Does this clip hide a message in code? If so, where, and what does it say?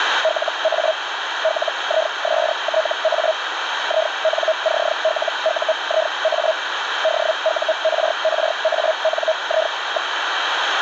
Yes: Hellschreiber (Feld-Hell, 122.5 baud) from 0.2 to 10.1 s, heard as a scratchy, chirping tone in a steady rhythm, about 640 Hz, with radio static. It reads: LA LISTA INCLUIA DURRANI.